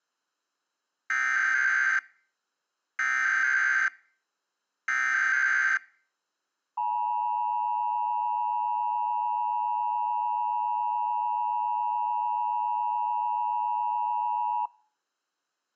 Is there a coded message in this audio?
Yes: Emergency Alert System (SAME) tones (header bursts, then the 853 and 960 Hz attention tone) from 1.1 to 14.7 s, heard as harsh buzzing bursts, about 520.83 baud.